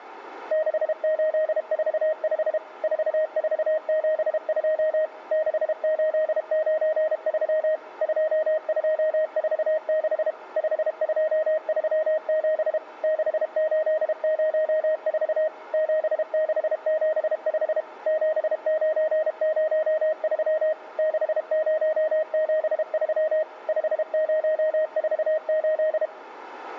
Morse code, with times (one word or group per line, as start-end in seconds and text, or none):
0.5-2.6 6845
2.8-5.1 4472
5.3-7.8 6893
8.0-10.3 2246
10.6-12.8 5237
13.0-15.5 6804
15.7-17.8 7675
18.1-20.7 7903
21.0-23.4 6073
23.7-26.1 5048